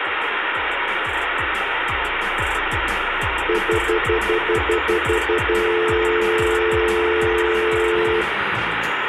Telephone call progress tone (North American plan), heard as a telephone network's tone, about 350, 440 Hz, 0.1 s on and 0.1 s off, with phone line noise and room echo. Stutter dial tone.